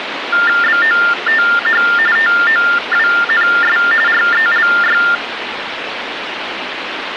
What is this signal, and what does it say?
TTY/TDD text telephone tones (45.45 baud Baudot), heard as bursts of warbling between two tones, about 400 Hz shift, 1600 Hz centre, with phone line noise. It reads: BOTH TOWNS RELY